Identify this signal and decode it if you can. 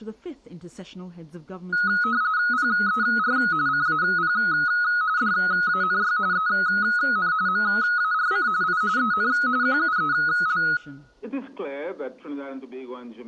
RTTY (45.45 baud, 170 Hz shift), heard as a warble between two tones, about 1360 Hz centre, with room echo. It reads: PER CAP DANY EN MARC I EN QUEL